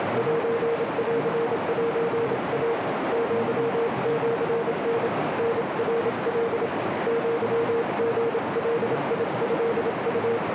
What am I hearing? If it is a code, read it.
Morse code (Japanese Wabun code), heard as a keyed tone, hand-sent with a paddle, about 27 wpm, 460 Hz, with heavy radio static, a narrow filter and speech in Manipuri. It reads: センセイ アシタ タナカ アリガトウ